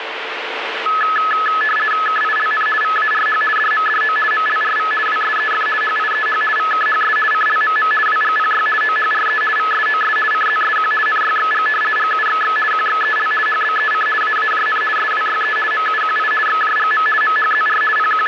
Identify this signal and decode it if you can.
RTTY (50 baud, 450 Hz shift), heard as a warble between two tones, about 1500 Hz centre, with radio static. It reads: KILN VARH DMDO MLRV WSEF HIEH VKHS CLMM WGPY OHRE VSOS CZSQ NYXG GUXX QXEL HBEC AAJN SWYE MUQI XJGM MHZR …